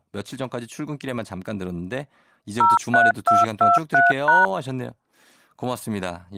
DTMF, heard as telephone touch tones, dialled by machine, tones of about 170 ms, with speech in Korean. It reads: 03223#